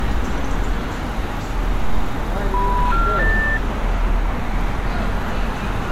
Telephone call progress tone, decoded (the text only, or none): special information tone